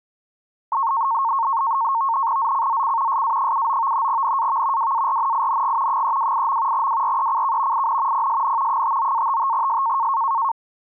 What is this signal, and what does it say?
NAVTEX (SITOR-B), 100 baud, 170 Hz shift, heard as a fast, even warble, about 1000 Hz centre. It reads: ZCZC SA79 NAV WARNING 328. WRECK IN PSN 59-55S